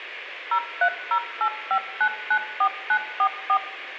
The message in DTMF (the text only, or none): 03085994944